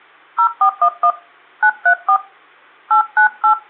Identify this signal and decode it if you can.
DTMF, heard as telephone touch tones, dialled by hand, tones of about 90 ms, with hum. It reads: 0411 934 898